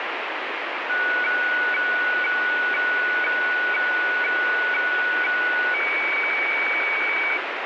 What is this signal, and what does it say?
Weather fax (radiofax), 120 lines a minute, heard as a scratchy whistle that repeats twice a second, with heavy radio static.